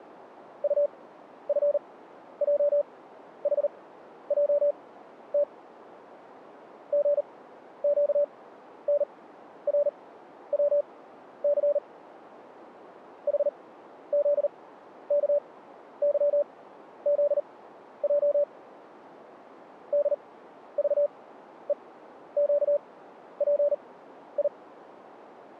Morse code, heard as a keyed tone, machine-sent, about 39 wpm, spaced as for 12 wpm, 580 Hz. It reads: UFJHJT GQNRWC HZKYZJ DVEQPI